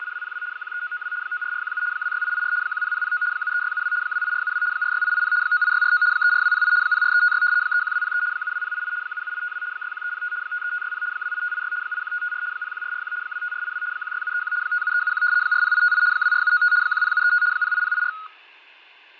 RTTY (75 baud, 170 Hz shift), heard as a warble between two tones, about 1360 Hz centre, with fading. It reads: … 13992 94417 26884 10009 73672 28472 46880 98649 34208 04356 31203 72088 77852 61305 53560 28586 81554 01441 25482 16731 57371 40858 24795 10735 08084